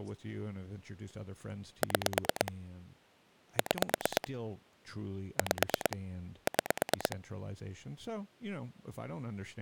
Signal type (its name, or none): pulse dialling